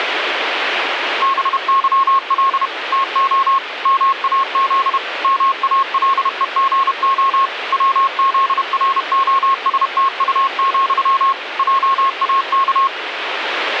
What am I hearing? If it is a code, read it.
Morse code, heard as a keyed tone, machine-sent, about 31 wpm, 1080 Hz, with radio static. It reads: BYL TO MAZ MALEGO WZROSTU, JAK